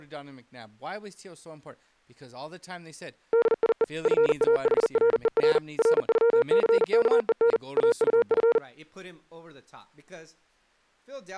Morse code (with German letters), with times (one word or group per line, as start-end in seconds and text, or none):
3.3-3.8 DIE
4.1-5.6 FAHRER
5.8-7.6 RÜCKEN
7.8-8.6 AUF